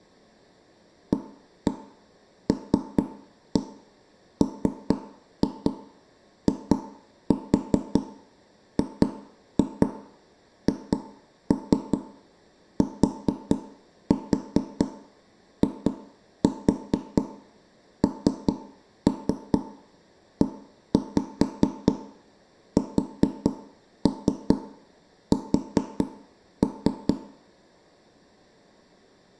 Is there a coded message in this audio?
Yes: tap code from 1.1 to 27.1 s, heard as knocks on wood, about 4 knocks a second, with room echo. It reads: ALMIGHTINESS